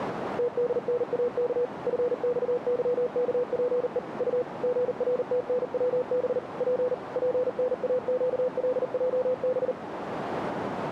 Morse code, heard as a keyed tone, machine-sent, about 39 wpm, 500 Hz, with radio static and a narrow filter. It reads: TDNAK FXYKPE U GRTNWB P PNAQLJB